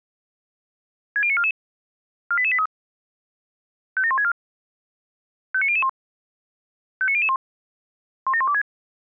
Five-tone selective call (ZVEI), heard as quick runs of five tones, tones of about 70 ms. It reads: 60944 48883 57164 59001 59001 17126